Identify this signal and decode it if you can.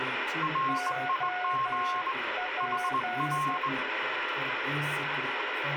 Morse code, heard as two keyed tones, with radio static. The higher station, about 20 wpm, 1070 Hz: RIG HR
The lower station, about 12 wpm, 730 Hz: OP